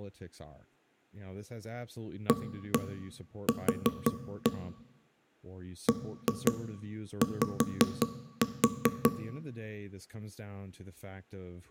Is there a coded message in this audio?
Yes: tap code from 2.3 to 9.2 s, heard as knocks on wood, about 5 knocks a second, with room echo and speech in English. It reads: AQ BY